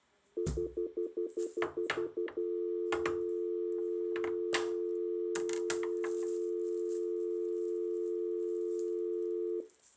Telephone call progress tone (North American plan), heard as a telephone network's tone, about 350, 440 Hz, 0.1 s on and 0.1 s off, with kitchen noise. Stutter dial tone.